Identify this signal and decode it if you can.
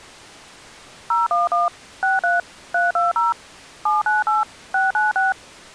DTMF, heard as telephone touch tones, dialled by machine, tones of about 160 ms. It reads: 011 63 320 798 696